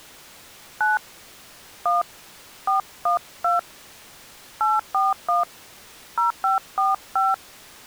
DTMF, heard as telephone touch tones, dialled by hand, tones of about 160 ms. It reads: 9 1 412 841 0545